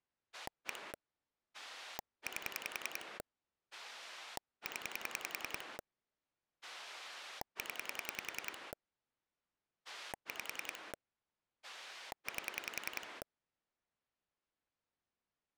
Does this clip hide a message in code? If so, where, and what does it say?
Yes: pulse dialling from 0.3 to 13.2 s, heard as a rotary dial, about 10 pulses a second. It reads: 1 8 0 0 5 8